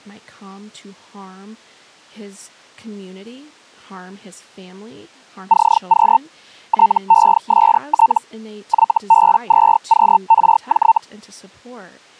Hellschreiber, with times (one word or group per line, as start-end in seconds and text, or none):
5.5-6.2 CQ
6.7-8.2 TEST
8.7-11.0 YB2QRJ